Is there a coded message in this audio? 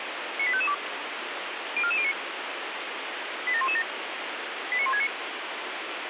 Yes: five-tone selective call (ZVEI) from 0.4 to 5.1 s, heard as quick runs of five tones, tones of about 70 ms, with radio hiss. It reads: 98552 04409 87117 89169